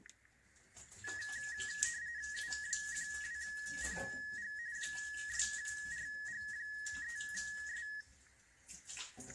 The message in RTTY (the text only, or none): U12PG 6RG3S